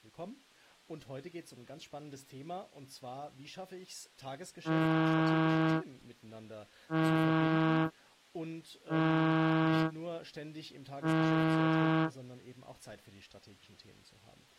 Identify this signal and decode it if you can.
Ship horn signal, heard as a ship's horn, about 160 Hz, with speech in German. 4 short. At sea: a pilot vessel's identity signal in fog.